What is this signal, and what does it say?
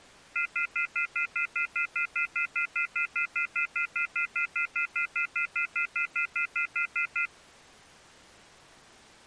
Telephone call progress tone (North American plan), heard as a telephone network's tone, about 1400, 2050, 2450, 2600 Hz, 0.1 s on and 0.1 s off. Off-hook warning tone.